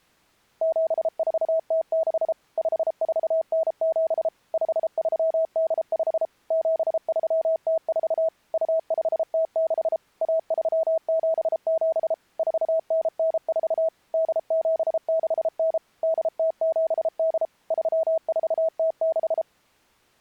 Morse code (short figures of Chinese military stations), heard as a keyed tone, machine-sent, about 33 wpm, 650 Hz. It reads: 7406 5497 5385 7304 2506 1377 4994 8769 8078 3406